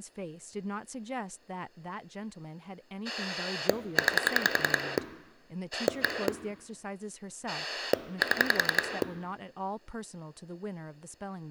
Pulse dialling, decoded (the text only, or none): 9 1 7